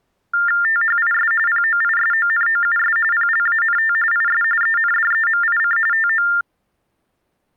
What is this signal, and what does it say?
TTY/TDD text telephone tones (45.45 baud Baudot), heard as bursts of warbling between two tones, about 400 Hz shift, 1600 Hz centre. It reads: THIS POISONOUS PLANT IS ENDEMIC TO